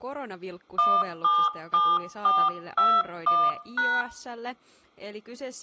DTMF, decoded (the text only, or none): 177421#